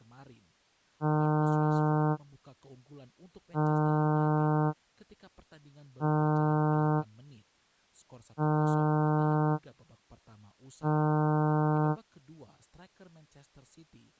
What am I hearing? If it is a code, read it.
Ship horn signal, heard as a ship's horn, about 150 Hz, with speech in Indonesian. 5 short. At sea: I doubt that you are doing enough to avoid a collision.